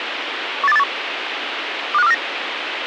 Five-tone selective call (EEA), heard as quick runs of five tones, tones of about 40 ms, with radio hiss. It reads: 18281 25249